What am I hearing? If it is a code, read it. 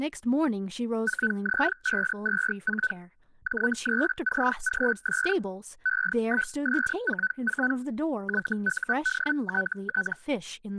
Hellschreiber (Feld-Hell, 122.5 baud), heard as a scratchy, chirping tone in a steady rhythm, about 1500 Hz, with speech in English. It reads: 4Z524 J3CGS E1S44 YUDTT